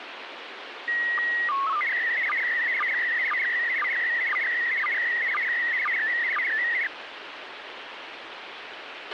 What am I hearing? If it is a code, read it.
SSTV (slow-scan television), PD 120, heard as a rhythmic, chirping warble, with radio hiss and a squelch burst at the end.